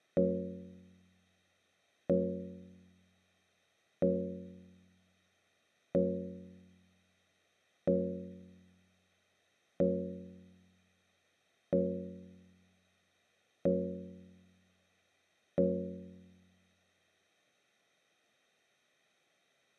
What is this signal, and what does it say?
Clock strike, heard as a bell, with room echo. 9. Nine o'clock.